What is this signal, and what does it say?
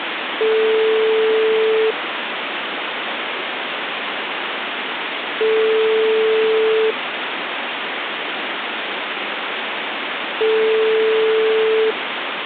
Telephone call progress tone (single-tone plan, as in most of Europe), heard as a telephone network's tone, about 440 Hz, 1.5 s on and 3.5 s off, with phone line noise. Ringback tone.